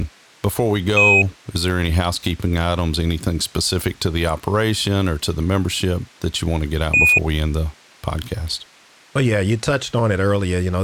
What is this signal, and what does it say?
Quindar tones, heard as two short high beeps, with speech in English.